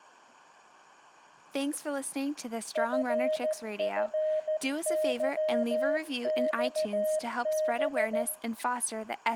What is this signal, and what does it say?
Morse code, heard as a keyed tone, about 14 wpm, 620 Hz, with room echo and speech in English. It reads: FFYXB